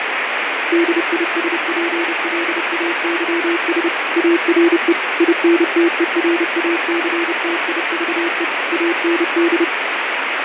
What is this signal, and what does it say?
Morse code, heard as a keyed tone, machine-sent, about 30 wpm, 340 Hz, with heavy radio static and fading. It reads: DISPLAYS ARE INTERACTIVE AND